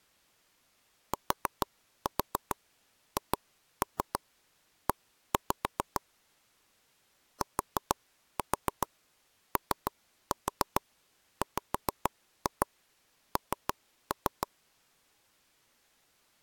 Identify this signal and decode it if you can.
Tap code, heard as taps on a table, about 6 knocks a second. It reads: THE TOWN